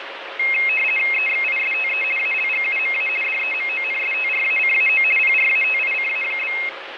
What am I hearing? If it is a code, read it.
RTTY (50 baud, 450 Hz shift), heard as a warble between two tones, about 2350 Hz centre, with radio static. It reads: EXISTE ALGUMA DEMONSTRACAO PRATICA?